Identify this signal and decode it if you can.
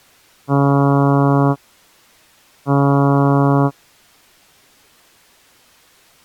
Ship horn signal, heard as a ship's horn, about 140 Hz. 2 short. At sea: I am altering course to port.